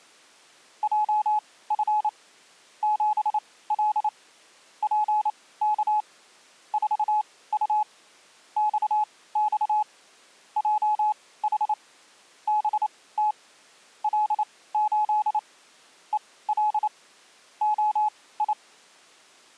Morse code, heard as a keyed tone, machine-sent, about 28 wpm, spaced as for 18 wpm, 850 Hz. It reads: JF 7L PK 4U XX JH BT L8 EL OI